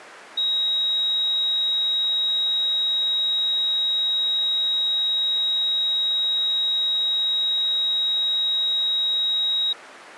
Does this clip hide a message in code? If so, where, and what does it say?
No, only a steady tone.